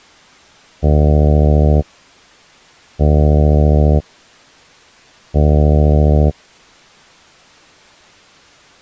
Ship horn signal, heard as a ship's horn, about 80 Hz. 3 short. At sea: I am operating astern propulsion.